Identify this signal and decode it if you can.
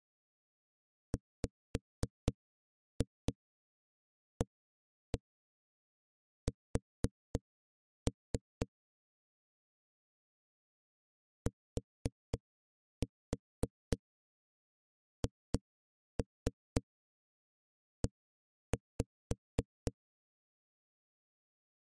Tap code, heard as knocks on a wall, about 3 knocks a second. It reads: WAS THE